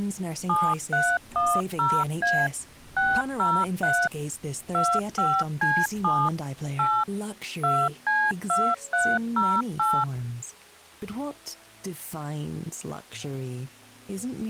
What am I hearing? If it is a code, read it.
DTMF, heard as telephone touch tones, dialled by machine, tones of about 240 ms. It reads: 7310A 603 25C7 8 2C2308